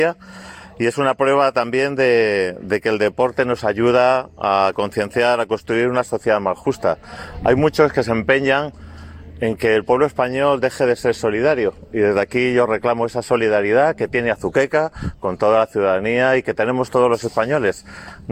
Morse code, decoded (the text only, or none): none